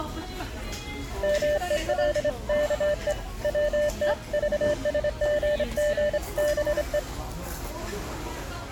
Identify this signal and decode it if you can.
Morse code (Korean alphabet), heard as a keyed tone, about 27 wpm, 590 Hz, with the noise of a restaurant. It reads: 막아 버렸다